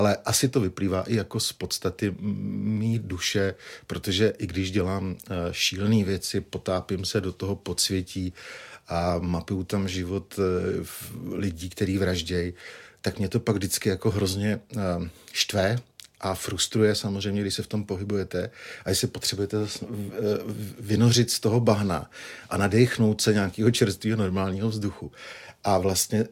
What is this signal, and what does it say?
Speech in Czech. There is no code.